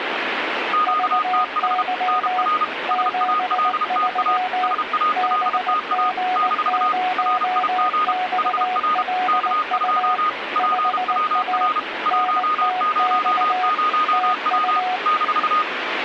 Morse code, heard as two keyed tones, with radio static. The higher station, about 32 wpm, 1240 Hz: QTH NR SALTA SALTA - RIG HR K2 PWR 100W -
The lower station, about 19 wpm, 740 Hz: VY 73 BG0XLU 5A NTX TU